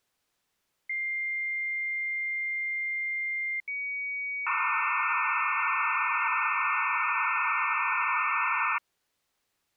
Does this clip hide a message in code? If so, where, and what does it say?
Yes: dial-up modem handshake (low-speed, two carriers) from 0.9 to 8.8 s, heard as two whistles, then hiss.